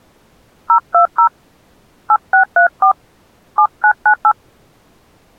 DTMF, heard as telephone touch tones, dialled by hand, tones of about 90 ms. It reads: 020 8634 7998